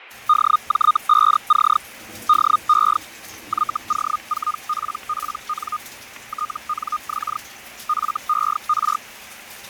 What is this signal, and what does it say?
Hellschreiber (Feld-Hell, 122.5 baud), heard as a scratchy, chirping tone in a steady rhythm, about 1230 Hz, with radio static, fading and kitchen noise. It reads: DJ5C DE YO4PPN TNX FER